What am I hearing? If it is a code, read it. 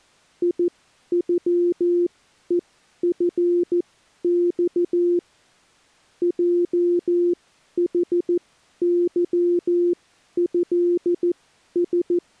Morse code (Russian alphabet), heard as a keyed tone, machine-sent, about 14 wpm, spaced as for 11 wpm, 350 Hz. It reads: ИЮЕФЬ ЙХЫЭС